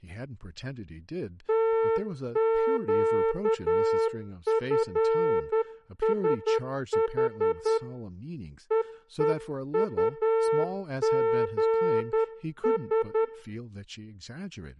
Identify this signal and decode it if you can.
Morse code, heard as a horn, hand-sent with a straight key, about 10 wpm, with room echo and speech in English. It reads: TQFSH EEUGS